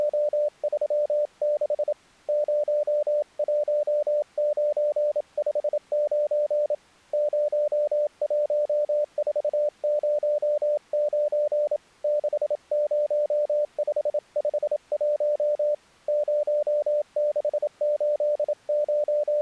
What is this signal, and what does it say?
Morse code, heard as a keyed tone, hand-sent with a paddle, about 27 wpm, 590 Hz. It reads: … 01959 01409 60551 …